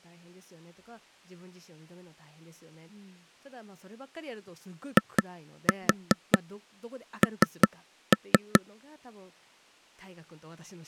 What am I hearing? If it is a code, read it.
Tap code, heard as taps on a table, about 4 knocks a second, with speech in Japanese. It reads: IN